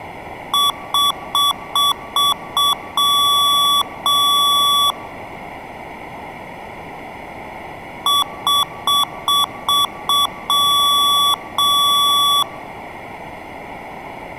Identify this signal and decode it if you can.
Beep code, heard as beeps from a small speaker, played twice, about 1140 Hz, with room echo. 6 short, 2 long.